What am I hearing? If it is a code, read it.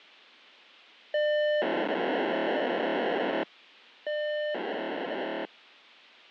POCSAG pager data (1200 baud), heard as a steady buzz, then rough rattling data, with a squelch burst at the end.